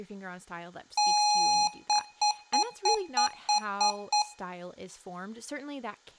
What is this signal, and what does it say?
Beep code, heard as beeps from a small speaker, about 830 Hz, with room echo and speech in English. 1 long, 8 short. In AMI BIOS tables: display or retrace test failure.